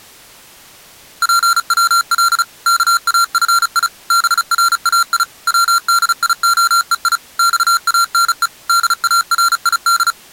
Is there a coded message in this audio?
Yes: Morse code (Persian alphabet) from 1.2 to 10.2 s, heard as electronic beeps, machine-sent, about 35 wpm, 1370 Hz. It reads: پول کافی برای ودیعهی خانه دارید